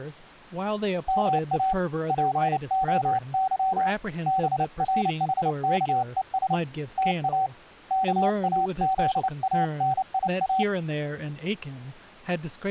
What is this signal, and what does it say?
Morse code (Greek alphabet), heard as a keyed tone, hand-sent with a paddle, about 29 wpm, 760 Hz, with speech in English. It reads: ΜΑ ΠΟΥ ΒΡΗΚΕΣ ΤΑ ΚΑΖΑΝΙΑ